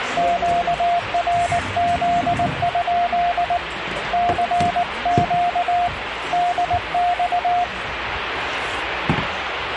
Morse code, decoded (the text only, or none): QRZ? CQ DX